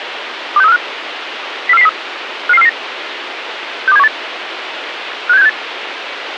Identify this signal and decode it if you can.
Five-tone selective call (EEA), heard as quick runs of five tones, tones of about 40 ms, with radio hiss. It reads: 26345 04403 55449 62718 56768